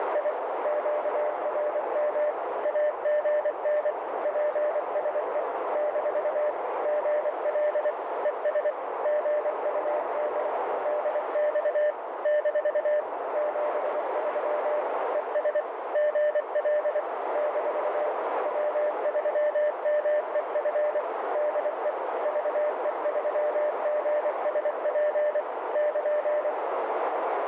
Morse code, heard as a keyed tone, machine-sent, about 24 wpm, 600 Hz, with heavy radio static and a narrow filter. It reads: … QRM AGN PSE - GL ES GUD DX - 73 ES GL - W3MEF DE VE3GSP <KN>